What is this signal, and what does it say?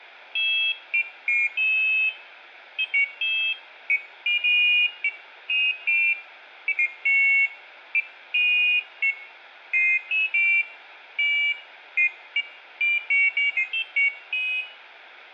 Pairs of high tones at irregular times, with room echo. There is no code.